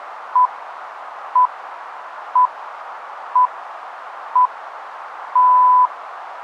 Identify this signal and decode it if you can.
Radio time signal (six pips, as the Greenwich Time Signal), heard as pips, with radio static.